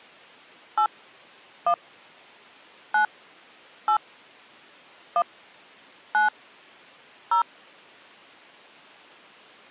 DTMF, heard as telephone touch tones, dialled by hand, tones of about 100 ms. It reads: 8 1 9 8 1 9 0